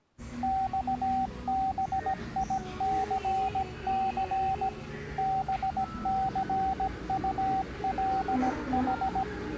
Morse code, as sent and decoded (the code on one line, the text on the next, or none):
-..- -... .. -.-. -.-. / -... -.-. ..- .-.. ....
XBICC BCULH